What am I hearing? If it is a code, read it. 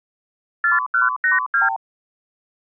Multi-frequency trunk signalling (R2, with the far end's replies), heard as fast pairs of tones, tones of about 150 ms. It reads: 4182